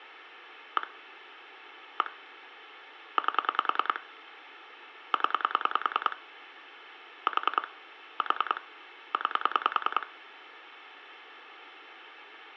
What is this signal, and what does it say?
Pulse dialling, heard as clicks on a phone line, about 10 pulses a second, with room echo. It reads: 1 1 8 0 4 4 9